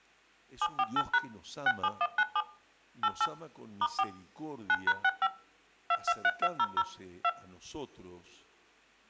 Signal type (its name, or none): DTMF